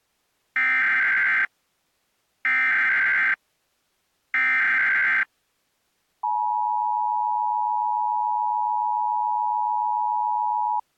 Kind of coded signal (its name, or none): Emergency Alert System (SAME) tones